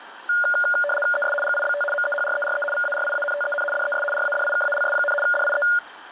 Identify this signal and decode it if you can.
RTTY (75 baud, 850 Hz shift), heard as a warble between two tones, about 1000 Hz centre, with radio static. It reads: ES GIBT MEHRERE VARIANTEN DES RADIKALS, DIE